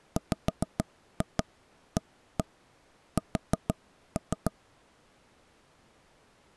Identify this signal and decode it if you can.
Tap code, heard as knocks on wood, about 6 knocks a second. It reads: WAS